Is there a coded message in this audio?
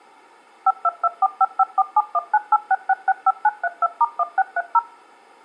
Yes: DTMF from 0.7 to 4.8 s, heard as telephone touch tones, dialled by machine, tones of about 40 ms. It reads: 522455471986665932*1630